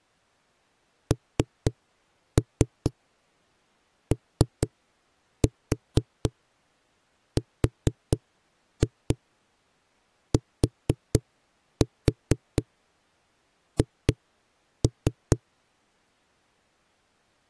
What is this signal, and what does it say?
Tap code, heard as knocks on a wall, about 4 knocks a second. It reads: NORTH